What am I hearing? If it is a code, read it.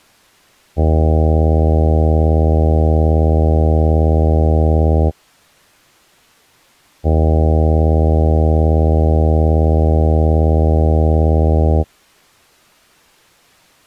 Ship horn signal, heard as a ship's horn, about 80 Hz. 2 long. At sea: a vessel under power that has stopped in fog.